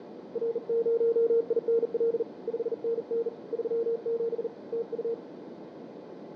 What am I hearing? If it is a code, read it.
Morse code, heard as a keyed tone, hand-sent with a bug key, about 40 wpm, 460 Hz, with radio static and a narrow filter. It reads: R0INL 5NN 37 TU